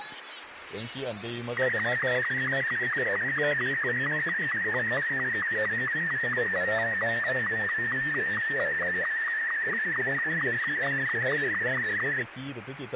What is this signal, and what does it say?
SSTV (slow-scan television), Martin M2, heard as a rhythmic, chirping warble, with radio static.